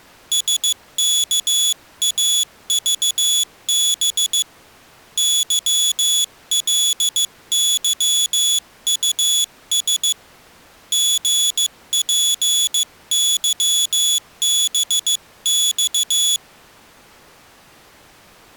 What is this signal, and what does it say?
Morse code, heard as a high beeper, hand-sent with a paddle, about 15 wpm, 3400 Hz. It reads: SKAVB YLYUS GPYBX